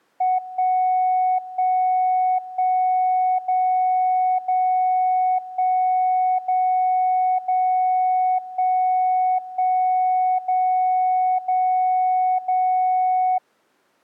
Radio time signal (DCF77), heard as a tone whose level steps once a second, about 740 Hz. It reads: 1 1 1 0 0 1 0 0 1 1 0 0 0